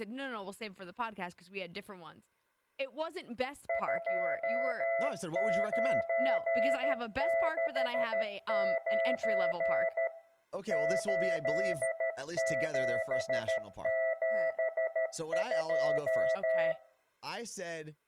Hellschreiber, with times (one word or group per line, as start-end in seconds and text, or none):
none